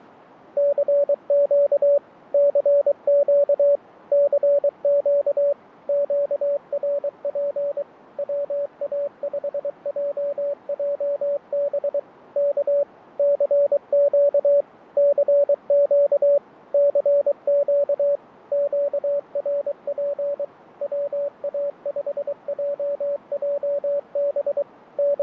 Morse code, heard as a keyed tone, machine-sent, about 23 wpm, 570 Hz, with fading. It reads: CQ CQ CQ QRP WA5JJB K CQ CQ CQ QRP WA5JJB …